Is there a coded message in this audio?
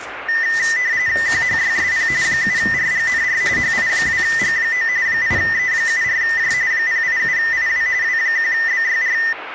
Yes: RTTY (45.45 baud, 170 Hz shift) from 0.3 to 9.3 s, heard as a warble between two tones, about 1900 Hz centre, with radio static and kitchen noise. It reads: QHYSP 7RGNR HI2G9 8E74J 087IW W1BYR